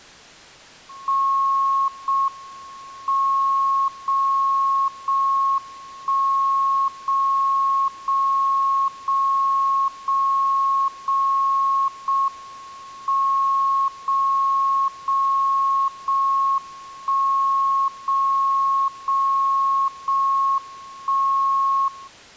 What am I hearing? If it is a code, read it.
Radio time signal (JJY), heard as a tone whose level steps once a second, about 1090 Hz. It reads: 0 M 0 0 1 0 0 0 0 0 0 M 0 0 0 1 0 0 0 1 0